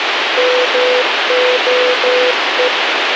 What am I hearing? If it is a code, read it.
Morse code, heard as a keyed tone, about 13 wpm, 500 Hz, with radio hiss and a squelch burst at the end. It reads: MOE